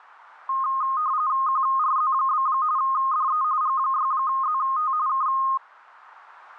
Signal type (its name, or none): RTTY